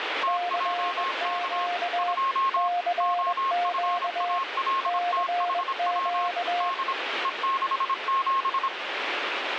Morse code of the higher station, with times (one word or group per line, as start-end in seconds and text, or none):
0.2-1.7 TJK
2.0-2.7 2
3.0-6.3 OFALTHW
6.6-6.9 D
7.2-8.7 E67